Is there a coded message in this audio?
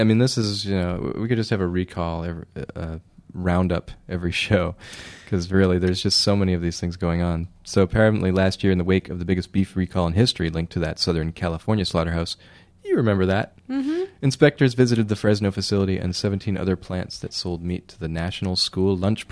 No, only speech in English.